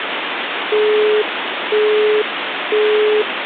Telephone call progress tone (single-tone plan, as in Europe, Japan and elsewhere), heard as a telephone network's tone, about 420 Hz, 0.5 s on and 0.5 s off, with phone line noise. Busy tone.